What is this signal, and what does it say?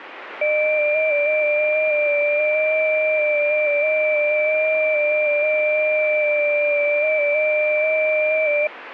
FT8 (several signals at once), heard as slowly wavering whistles, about 6.25 baud, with radio static.